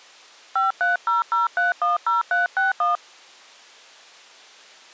DTMF, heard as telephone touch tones, dialled by hand, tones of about 150 ms. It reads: 5300310361